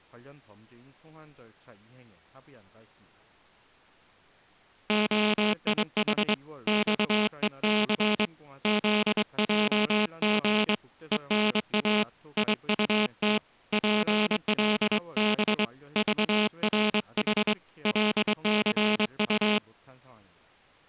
Morse code, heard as a buzzer, hand-sent with a straight key, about 23 wpm. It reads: OIH XEC ZJG ENA IUT PLB VRH LCU